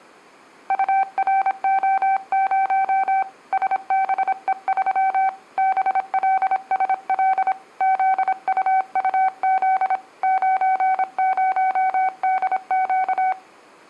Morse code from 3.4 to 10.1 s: SBE3 BLSL ZUUZ

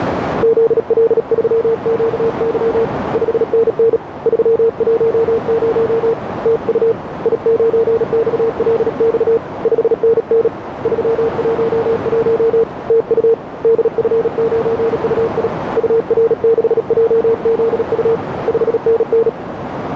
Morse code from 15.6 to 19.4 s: UR6JZU 5NN

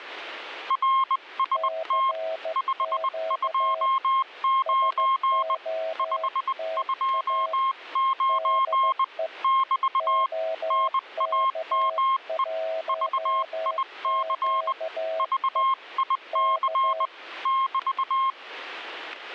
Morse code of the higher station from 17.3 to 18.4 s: <BT>

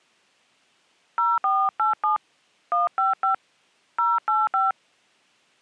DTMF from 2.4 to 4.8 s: 155 085

